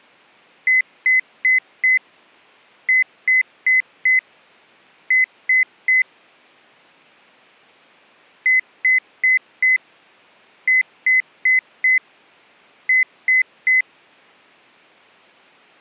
Beep code, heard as beeps from a small speaker, played twice, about 2050 Hz. 4-4-3. In Phoenix BIOS tables: maths coprocessor failure.